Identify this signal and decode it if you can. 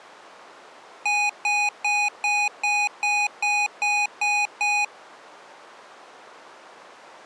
Beep code, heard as beeps from a small speaker, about 830 Hz. 10 short. In AMI BIOS tables: CMOS shutdown register error.